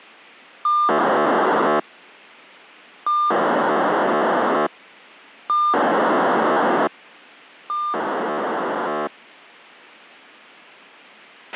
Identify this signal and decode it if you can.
POCSAG pager data (2400 baud), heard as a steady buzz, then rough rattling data, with a squelch burst at the end.